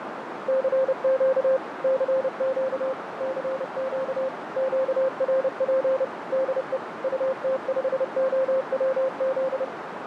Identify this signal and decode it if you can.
Morse code, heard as a keyed tone, machine-sent, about 30 wpm, 530 Hz, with radio static, fading and a narrow filter. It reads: CQ CQ CQ QRP DE UT5OWZ